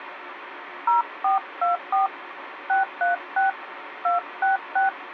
DTMF, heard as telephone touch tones, dialled by hand, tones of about 140 ms, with radio hiss. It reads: 0424 636 266